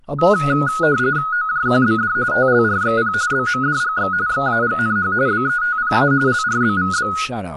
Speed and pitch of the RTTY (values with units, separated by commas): 45.45 baud, 170 Hz shift, 1360 Hz centre